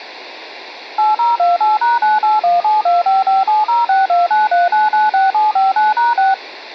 DTMF, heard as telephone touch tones, dialled by machine, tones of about 170 ms, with radio hiss. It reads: 8028#9817255706293996759#6